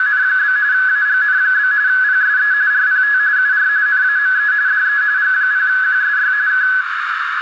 RTTY (45.45 baud, 170 Hz shift), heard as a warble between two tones, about 1600 Hz centre, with radio static and a narrow filter. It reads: … AGN? PSE RPT UR NAME DE G0QSY K